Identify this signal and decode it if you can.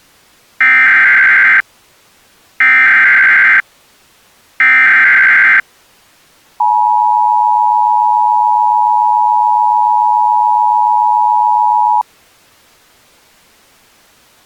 Emergency Alert System (SAME) tones (header bursts, then the 853 and 960 Hz attention tone), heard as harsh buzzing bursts, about 520.83 baud.